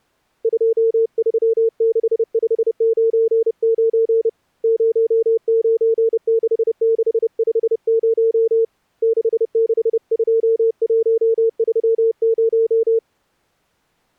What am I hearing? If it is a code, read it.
Morse code, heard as a keyed tone, hand-sent with a bug key, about 30 wpm, 450 Hz. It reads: 236599 096650 662130